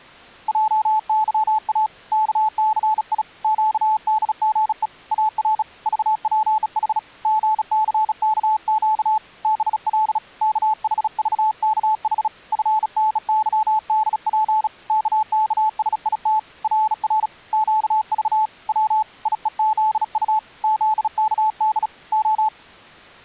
Morse code, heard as a keyed tone, hand-sent with a bug key, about 36 wpm, 870 Hz. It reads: JYA KCI QDGE AR VPH GCKQ BL KHVKH FNYDP KKSIT RR QV W IEZU ZKD O